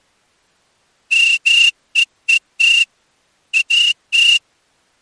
Morse code, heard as a whistle, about 14 wpm. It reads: MEET AT